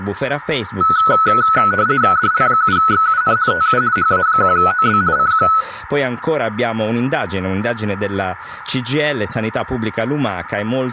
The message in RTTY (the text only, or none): DL7XUN TU HA1OB CQ